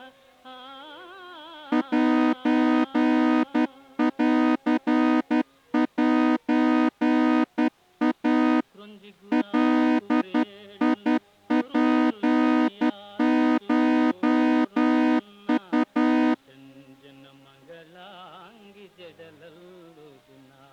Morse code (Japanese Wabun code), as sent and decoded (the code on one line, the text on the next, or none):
.---. .-.-. .---. .- / .-.. .. .--. ---- ..-
センセイ ガツコウ